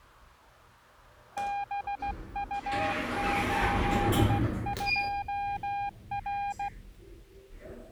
Morse code, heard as a keyed tone, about 16 wpm, 810 Hz, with the noise inside a lift. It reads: BU82R